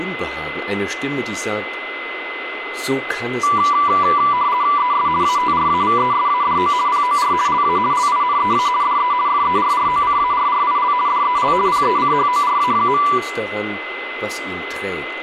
RTTY (50 baud, 170 Hz shift), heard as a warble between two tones, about 1080 Hz centre, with radio static and a steady whistle near 2040 Hz. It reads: ES ATRAVESADO POR LA LINEA DE FERROCARRIL DEL PECHORA.